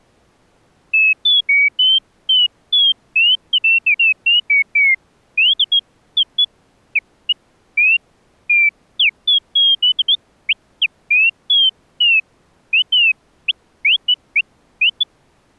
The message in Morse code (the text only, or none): none